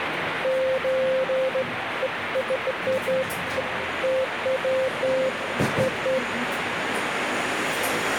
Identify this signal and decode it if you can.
Beeps of irregular length, with radio static and the noise of a cafe. There is no code.